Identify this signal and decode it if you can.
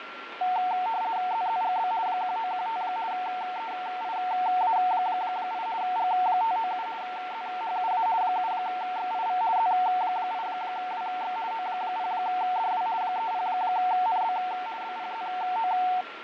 RTTY (50 baud, 170 Hz shift), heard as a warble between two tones, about 820 Hz centre, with radio static, fading and a steady whistle near 1370 Hz. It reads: ZZGB 1915 EIA8 G597 ZHUA 7XIV Z8WX O0DW 30NB BPZO